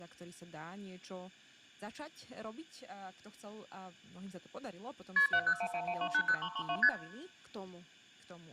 Multi-frequency trunk signalling (R1, as on North American trunks), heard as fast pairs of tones, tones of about 70 ms, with room echo and speech in Slovak. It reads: KP 70111280332 ST